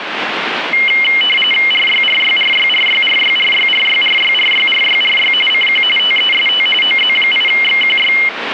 RTTY (45.45 baud, 850 Hz shift), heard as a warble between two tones, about 2550 Hz centre, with radio static. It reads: RYRYRYRYRYRYRYRYRYRYRY CQ TEST OZ8XQY